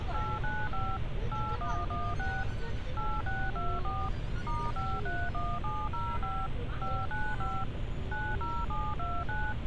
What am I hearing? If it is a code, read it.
DTMF, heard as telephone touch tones, dialled by machine, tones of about 240 ms, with phone line noise and street noise. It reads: 895 8116 8624 *531705 595 90729